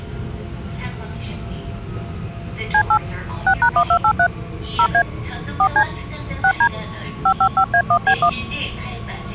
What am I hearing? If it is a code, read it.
DTMF, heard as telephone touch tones, dialled by hand, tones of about 80 ms, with the noise inside a subway train. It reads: C8 6#1283 0A 4C 6D 555A1B1